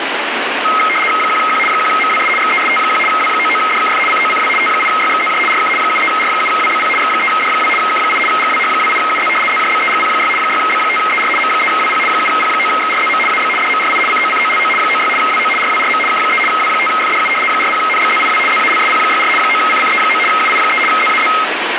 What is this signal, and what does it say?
RTTY (75 baud, 850 Hz shift), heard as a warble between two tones, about 1700 Hz centre, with radio static. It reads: 1Q 1MWS XEST1 W99DKF COCW T8YXZJ RK 73R7WBP X3D2 K8 GWH28UZ ZJBEGP6 6B5ER M3WP 7P9XRZM AB DMRI COCOLO 96 WO RWRM K3 W5FDU 40NBZIW ZALSP64 9CCE9 UI3 ZAZ